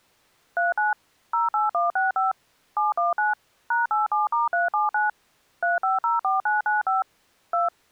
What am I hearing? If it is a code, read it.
DTMF, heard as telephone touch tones, dialled by machine, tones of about 160 ms. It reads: 39 08165 719 #87*379 3504995 2